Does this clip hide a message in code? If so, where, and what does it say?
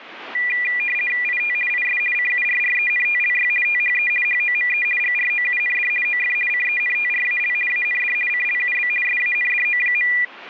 Yes: RTTY (50 baud, 450 Hz shift) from 0.3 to 10.2 s, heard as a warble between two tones, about 2200 Hz centre. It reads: IT IS CURRENTLY THE HOME GROUND OF CENTRAL AND CLUB SANDO.